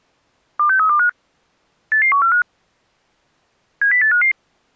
Five-tone selective call (CCIR), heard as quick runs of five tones, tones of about 100 ms. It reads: 26325 88145 70855